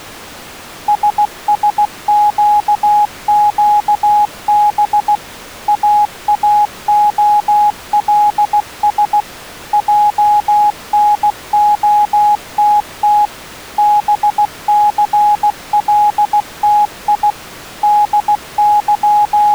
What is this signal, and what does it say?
Morse code, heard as a keyed tone, machine-sent, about 16 wpm, 830 Hz. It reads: SSQQB AAOLS JNOTT BCLTI …